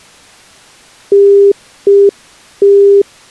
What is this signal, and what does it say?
Telephone call progress tone (UK plan), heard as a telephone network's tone, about 400 Hz. Congestion tone.